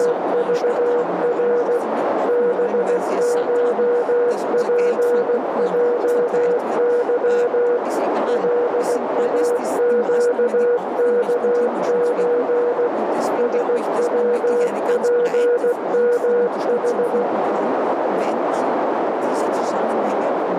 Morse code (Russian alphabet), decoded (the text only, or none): … БШПЙЫ ЛАЩКЧ СВПМХ